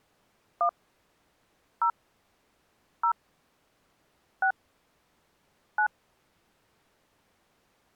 DTMF, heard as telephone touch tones, dialled by hand, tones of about 80 ms. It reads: 1 0 0 6 9